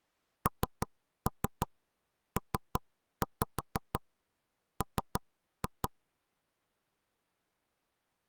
Tap code, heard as knocks on wood, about 5 knocks a second. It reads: NPM